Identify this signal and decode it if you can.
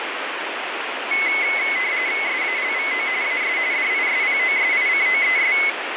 RTTY (45.45 baud, 170 Hz shift), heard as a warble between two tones, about 2100 Hz centre, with radio static. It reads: SALVO AS DISPOSICOES